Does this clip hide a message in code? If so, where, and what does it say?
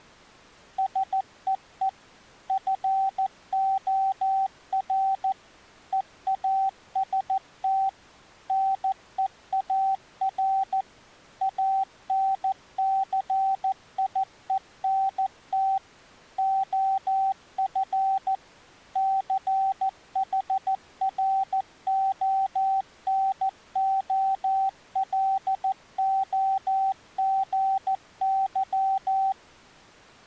Yes: Morse code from 0.7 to 29.4 s, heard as a keyed tone, machine-sent, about 14 wpm, 770 Hz. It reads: SEE FOR EAST NEAR ANCIENT OF CHRONOLOGY